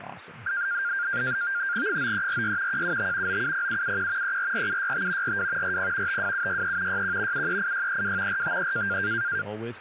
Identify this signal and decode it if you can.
NAVTEX (SITOR-B), 100 baud, 170 Hz shift, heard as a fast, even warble, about 1500 Hz centre, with radio static and speech in English. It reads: 9346 175 970771 344765 42 40 52763 61 738632 453